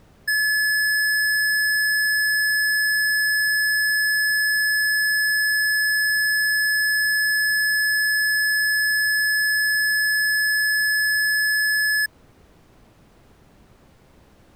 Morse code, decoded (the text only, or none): none